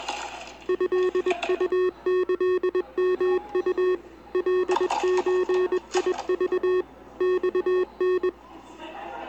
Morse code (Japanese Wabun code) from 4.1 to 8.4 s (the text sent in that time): カゾク マタ